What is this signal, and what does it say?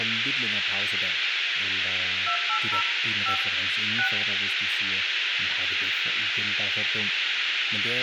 DTMF, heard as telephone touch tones, dialled by hand, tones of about 90 ms, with radio hiss, a squelch burst at the end, room echo and speech in Danish. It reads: 280 5 6